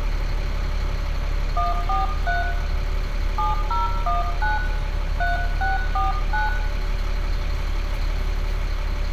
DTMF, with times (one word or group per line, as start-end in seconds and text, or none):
1.6-2.4 143
3.4-4.6 7019
5.2-6.5 3649